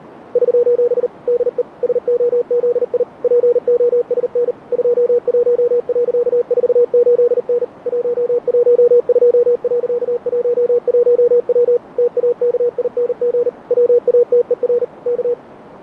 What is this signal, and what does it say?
Morse code, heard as a keyed tone, machine-sent, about 39 wpm, 480 Hz, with radio static. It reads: <SOS> DE SOZI POSN 21.48N 112.11W TAKING WATER K